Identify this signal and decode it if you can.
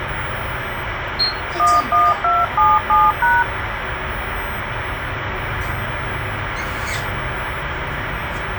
DTMF, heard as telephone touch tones, dialled by hand, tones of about 200 ms, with radio hiss and the noise inside a bus. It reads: 11277#